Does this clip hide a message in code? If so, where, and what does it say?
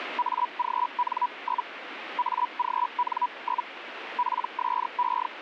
Yes: Hellschreiber (Feld-Hell, 122.5 baud) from 0.2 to 5.3 s, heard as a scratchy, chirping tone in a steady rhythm, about 980 Hz, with radio static. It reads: AGN? AGN? PSE